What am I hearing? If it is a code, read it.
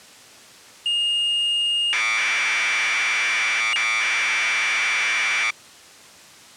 Commodore tape loading (standard loader), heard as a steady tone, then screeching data.